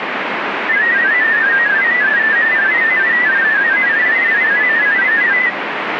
Multi-tone FSK (Olivia or MFSK type), about 500 Hz wide, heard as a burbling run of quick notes, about 31.25 baud, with radio static.